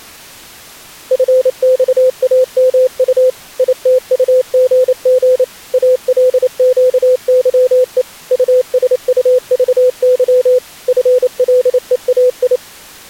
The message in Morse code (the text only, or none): FXAMU ITUGG ALQYE USUVY FLEAI